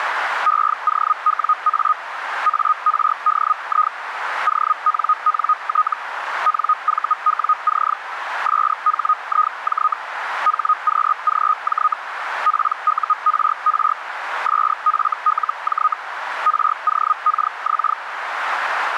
Hellschreiber (Feld-Hell, 122.5 baud), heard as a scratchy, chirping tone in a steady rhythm, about 1250 Hz, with radio static and a narrow filter. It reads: EOWA ARDI ONNT NVWC SHIJ HQGJ PURR SFLJ ROKX